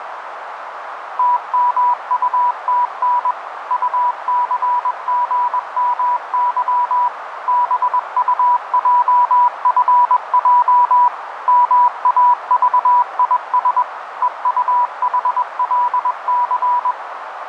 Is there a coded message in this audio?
Yes: Morse code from 1.1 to 17.0 s, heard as a keyed tone, machine-sent, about 21 wpm, 980 Hz, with radio static and a narrow filter. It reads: TMUTN UCGMY BUJFJ MAVIS EUHLC